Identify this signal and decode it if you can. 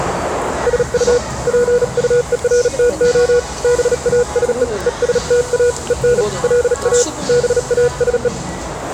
Morse code, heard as a keyed tone, hand-sent with a paddle, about 37 wpm, 480 Hz, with radio static and the noise of a restaurant. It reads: SU PUERTO BASE ESTA EN LA BASE